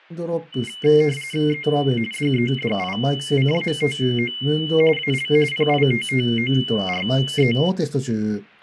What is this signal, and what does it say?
RTTY (45.45 baud, 850 Hz shift), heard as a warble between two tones, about 2550 Hz centre, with radio static. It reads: E DEDICATO AL PITTORE